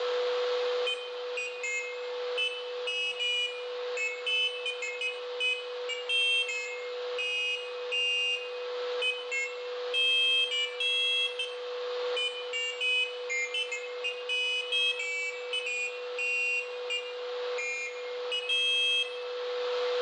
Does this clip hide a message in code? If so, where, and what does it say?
No, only pairs of high tones at irregular times, with a steady whistle near 490 Hz and room echo.